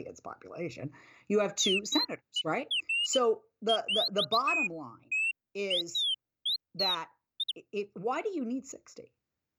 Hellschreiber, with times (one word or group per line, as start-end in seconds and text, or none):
none